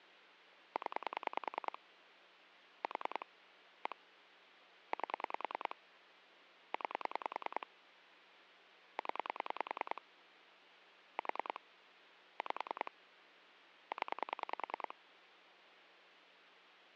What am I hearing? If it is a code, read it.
Pulse dialling, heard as clicks on a phone line, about 10 pulses a second, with phone line noise. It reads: 0 4 1 8 9 0 4 5 0